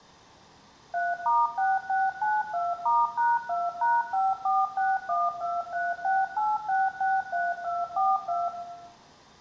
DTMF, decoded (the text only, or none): 3*6692*#2#54612368663242